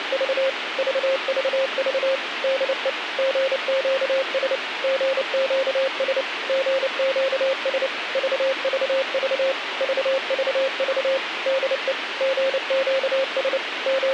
Morse code, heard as a keyed tone, machine-sent, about 29 wpm, 540 Hz, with radio hiss. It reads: … VVV DE GQS GQS GQS VVV VVV DE GQS …